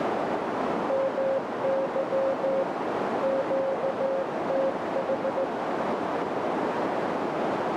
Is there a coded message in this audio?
Yes: Morse code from 0.8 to 5.5 s, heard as a keyed tone, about 15 wpm, 540 Hz, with heavy radio static and a narrow filter. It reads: MY QTH